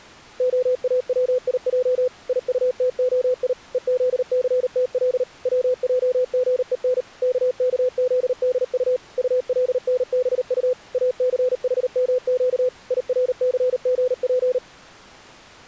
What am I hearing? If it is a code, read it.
Morse code (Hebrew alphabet), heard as a keyed tone, machine-sent, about 38 wpm, 500 Hz. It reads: האציע יטתהי וזסתל צעגון ככזדט טלנבט אסחמק ירסגף